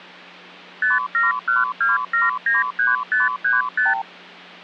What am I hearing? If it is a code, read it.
Multi-frequency trunk signalling (R2, with the far end's replies), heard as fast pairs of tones, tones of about 160 ms, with hum. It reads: 5712793535